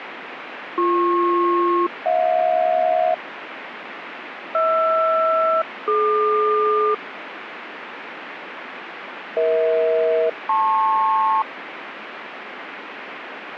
Aircraft SELCAL, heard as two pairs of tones, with radio static. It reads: BP-HJ HR-DQ EH-LP